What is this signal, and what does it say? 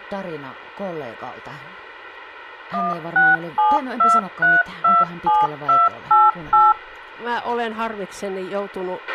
DTMF, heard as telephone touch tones, dialled by machine, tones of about 190 ms, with a squelch burst at the end and speech in Finnish. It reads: 1672327288